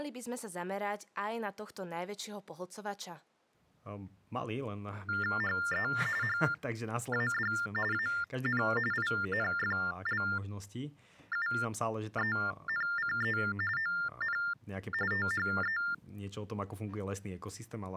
TTY/TDD text telephone tones (45.45 baud Baudot), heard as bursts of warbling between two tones, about 400 Hz shift, 1600 Hz centre, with speech in Slovak. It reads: HE HAD AN INFLUENCE ON THE